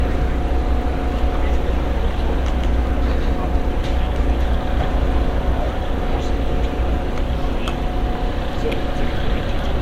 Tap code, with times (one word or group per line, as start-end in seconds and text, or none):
none